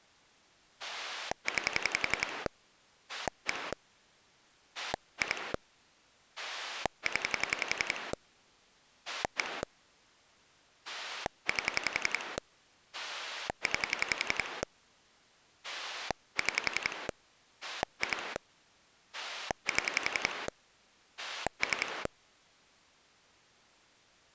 Pulse dialling, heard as a rotary dial, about 11 pulses a second. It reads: 9 1 2 0 1 8 9 6 2 7 3